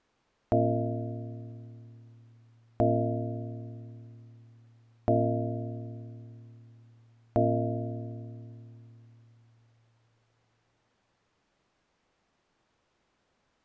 Clock strike, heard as a bell. 4. Four o'clock.